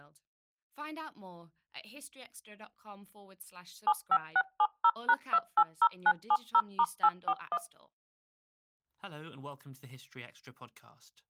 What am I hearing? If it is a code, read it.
DTMF, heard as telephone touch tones, dialled by machine, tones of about 60 ms, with speech in English. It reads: 75670#280970*841